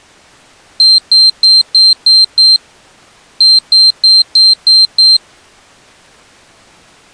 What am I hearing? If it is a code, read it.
Beep code, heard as a piezo beeper, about 4150 Hz. 6-6.